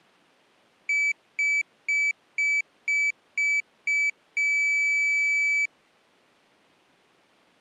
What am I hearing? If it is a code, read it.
Beep code, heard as a piezo beeper, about 2300 Hz. 7 short, 1 long.